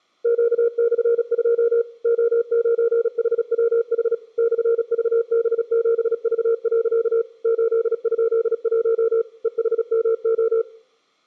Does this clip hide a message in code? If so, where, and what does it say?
Yes: Morse code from 0.2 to 10.7 s, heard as a keyed tone, machine-sent, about 36 wpm, 460 Hz. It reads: Q/2 O9HWH /VB7V. 8?1 EHMO